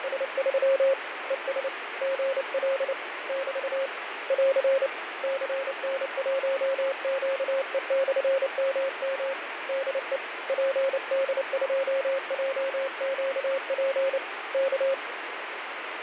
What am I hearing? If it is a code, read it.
Morse code, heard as a keyed tone, hand-sent with a paddle, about 29 wpm, 540 Hz, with radio static and fading. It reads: … ES GL <BT> <AR> CN1QE/MM DE PD2JQP K